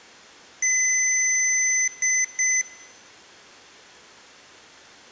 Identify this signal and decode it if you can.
Beep code, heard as beeps from a small speaker, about 2050 Hz, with room echo. 1 long, 2 short. In Award, IBM and AMI BIOS tables: video adapter failure.